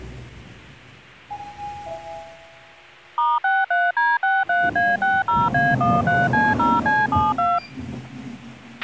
DTMF, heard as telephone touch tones, dialled by machine, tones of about 200 ms, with a squelch burst at the end and the noise inside a lift. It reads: *63D63A60A13C0C72